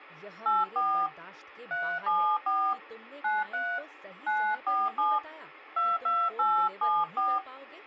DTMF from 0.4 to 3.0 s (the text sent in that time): 84 374